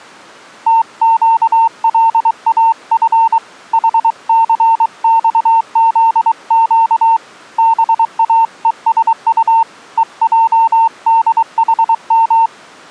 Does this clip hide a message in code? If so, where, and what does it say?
Yes: Morse code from 0.6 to 12.5 s, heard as a keyed tone, hand-sent with a paddle, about 23 wpm, 910 Hz. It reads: TQLAF HCXZQ BAESU EJDHM